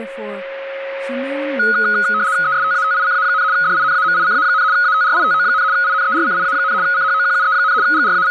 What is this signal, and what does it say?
RTTY (75 baud, 170 Hz shift), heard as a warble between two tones, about 1360 Hz centre, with a steady whistle near 550 Hz and speech in English. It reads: ESTATICA, DINAMICA, ATRITO, INERCIA, CHOQUE, …